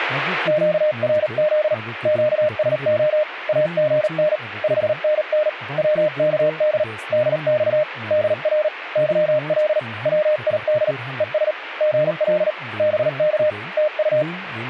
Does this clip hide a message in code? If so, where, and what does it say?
Yes: Morse code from 0.4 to 14.3 s, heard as a keyed tone, hand-sent with a paddle, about 38 wpm, 610 Hz, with speech in Santali. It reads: QRZ QSO AGN 5NN WKD DX DR YL WID ES GL BK TU